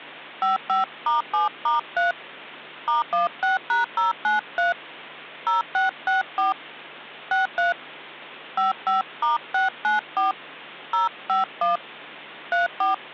DTMF, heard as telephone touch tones, dialled by hand, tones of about 140 ms, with hum. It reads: 55*7*3 *16#093 0664 63 55*694 051 34